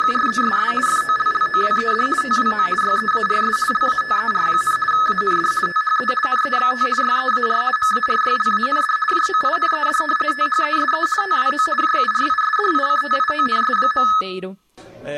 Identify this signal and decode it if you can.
RTTY (50 baud, 450 Hz shift), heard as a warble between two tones, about 1500 Hz centre, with room echo. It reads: … FOLLOWED TWO YEARS LATER, AND THE NEXT YEAR MARYLAND JOINED THESE TWO JURISDICTIONS.